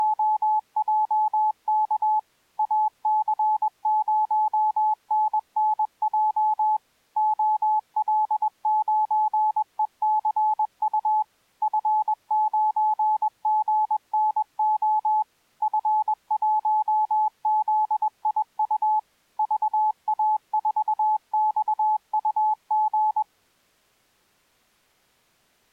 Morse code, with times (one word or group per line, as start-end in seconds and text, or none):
0.0-2.2 …
2.6-6.8 AC0NNJ
7.2-11.2 OL9ECU
11.6-15.2 F9GNO
15.6-19.0 F1ZIU
19.4-23.2 VA4XUG